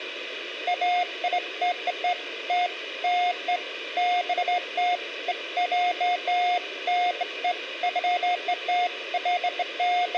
Beeps of irregular length, with radio hiss and room echo. There is no code.